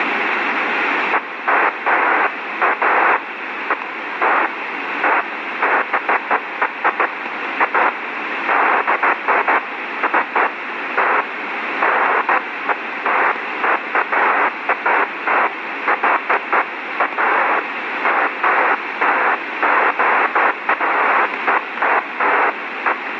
Bursts of noise, with radio static. There is no code.